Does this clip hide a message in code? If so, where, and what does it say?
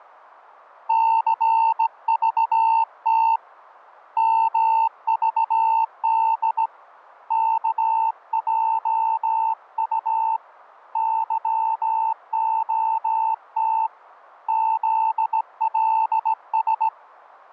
Yes: Morse code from 0.8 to 16.9 s, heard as a keyed tone, hand-sent with a straight key, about 17 wpm, 900 Hz. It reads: CVT MVD KJU YOT ZLS